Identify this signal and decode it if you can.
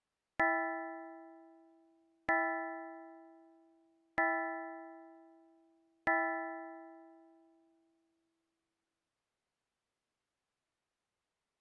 Clock strike, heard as a bell. 4. Four o'clock.